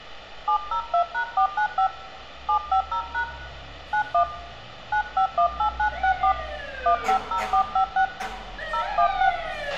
DTMF, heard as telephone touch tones, dialled by hand, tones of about 90 ms, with a squelch burst at the end, room echo and street noise. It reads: 702#495 750# 91 9518964 150456 016